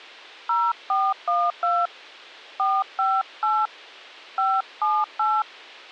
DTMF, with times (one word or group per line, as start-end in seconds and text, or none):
0.5-1.9 0412
2.6-3.7 458
4.4-5.4 578